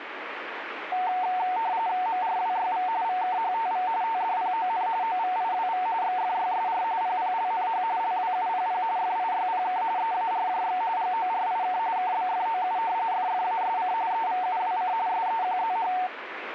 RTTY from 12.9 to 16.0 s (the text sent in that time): FFASC EVUWC SEQZH